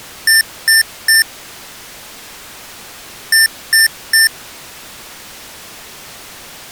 Beep code, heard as beeps from a small speaker, played twice, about 1800 Hz. 3 short. In AMI BIOS tables: failure in the first 64 KB of memory; in Dell tables: chipset error.